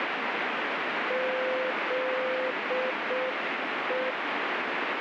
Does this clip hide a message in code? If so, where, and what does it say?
Yes: Morse code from 1.0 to 4.2 s, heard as a keyed tone, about 6 wpm, 520 Hz, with heavy radio static. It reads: ZE